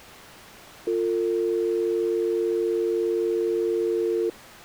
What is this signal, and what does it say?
Telephone call progress tone (North American or UK plan), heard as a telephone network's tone, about 350, 450 Hz. Dial tone.